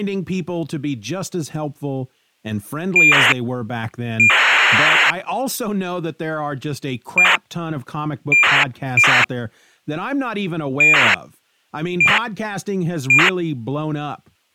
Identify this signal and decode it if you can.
ACARS aircraft data, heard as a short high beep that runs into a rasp, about 2400 baud, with speech in English.